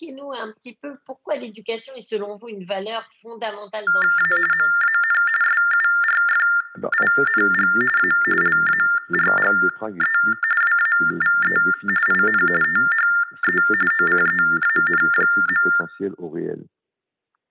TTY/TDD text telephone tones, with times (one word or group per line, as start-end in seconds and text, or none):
4.2-4.3 A
4.5-5.2 MAN
5.4-7.7 SURFING
8.0-8.1 A
8.4-10.2 LARGE
10.6-11.6 WAVE
12.1-12.4 IN
12.6-13.6 THE
13.9-15.7 OCEAN.